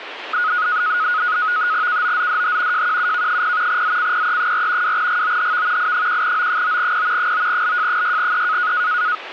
NAVTEX (SITOR-B), 100 baud, 170 Hz shift, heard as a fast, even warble, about 1360 Hz centre, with radio static. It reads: KOZDH JQUK0 ZCPE4 2GOHV I1O9P 9LJ6E